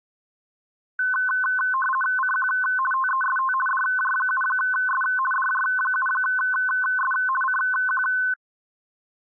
RTTY (50 baud, 450 Hz shift), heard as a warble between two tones, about 1280 Hz centre. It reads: CQ TEST DJ7S DJ7S CQ